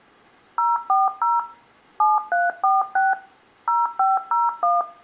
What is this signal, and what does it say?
DTMF, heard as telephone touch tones, dialled by machine, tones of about 180 ms, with room echo. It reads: 040 7346 0501